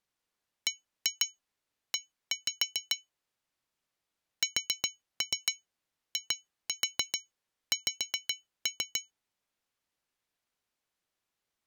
Tap code, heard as taps on glass, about 7 knocks a second. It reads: BE SIX